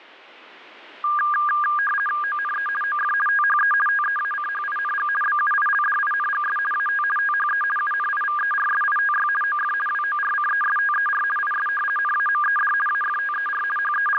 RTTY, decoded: ONE OF THE TEACHING BUILDINGS AT THE UNIVERSITY OF WORCESTER IS NAMED AFTER …

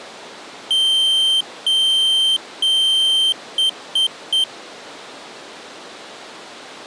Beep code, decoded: 3 long, 3 short

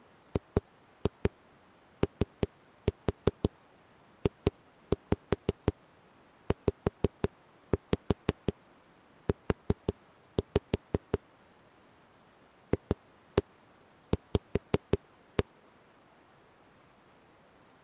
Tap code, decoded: GOJZU FV

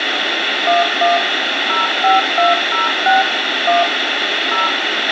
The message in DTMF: 11 05206 1 0

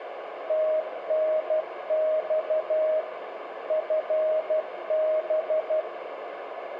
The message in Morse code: TNX FB

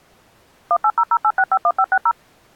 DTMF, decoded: 18008651560

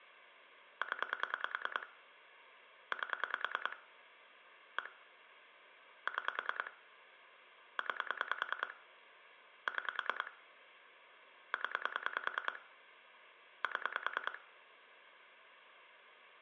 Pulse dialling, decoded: 0 8 1 6 9 6 0 7

